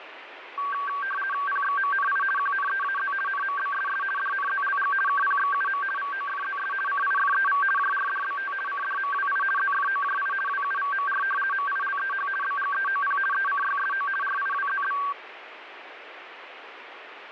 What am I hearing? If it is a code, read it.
RTTY (50 baud, 450 Hz shift), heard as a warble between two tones, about 1350 Hz centre, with radio static. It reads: PXMNI QNEAZ NMBSS DNZLG KPXUM VOFZS CIFEV JRDBT CDMWI ZFOJI WUVMR MILEH BGEOP ECYSO RIWZB